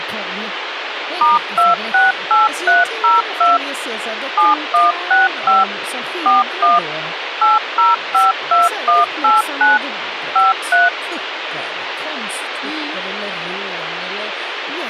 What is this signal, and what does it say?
DTMF, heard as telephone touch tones, dialled by machine, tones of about 170 ms, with radio hiss and speech in Swedish. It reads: *268302 7165 41 8052189 53